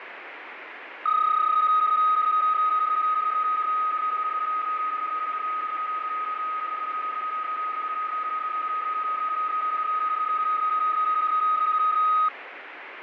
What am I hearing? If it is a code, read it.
PSK31 (31.25 baud), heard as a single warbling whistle, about 1260 Hz, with radio static and fading.